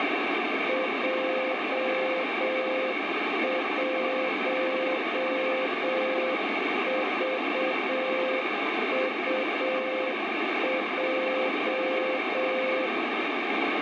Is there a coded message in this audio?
Yes: Morse code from 0.6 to 12.9 s, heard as a keyed tone, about 7 wpm, 520 Hz, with heavy radio static and room echo. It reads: J1VUJ